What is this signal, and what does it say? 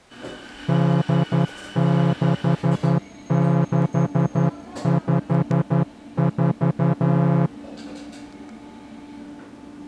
Morse code, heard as a horn, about 11 wpm, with the noise of a cafe. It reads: D6654